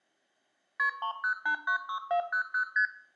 Multi-frequency trunk signalling (R1, as on North American trunks), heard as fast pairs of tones, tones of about 90 ms, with room echo. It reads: KP 30896400 ST